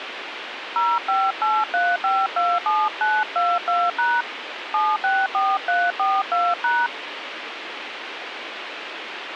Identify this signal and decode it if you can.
DTMF, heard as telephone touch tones, dialled by hand, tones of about 220 ms, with radio hiss. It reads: 0583527922# 764342#